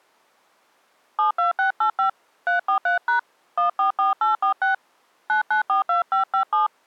DTMF, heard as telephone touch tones, dialled by hand, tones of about 120 ms. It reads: 72685 343# 144846 9942557